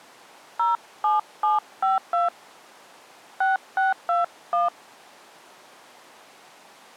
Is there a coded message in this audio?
Yes: DTMF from 0.6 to 4.7 s, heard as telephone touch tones, dialled by hand, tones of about 160 ms. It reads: 07752 6621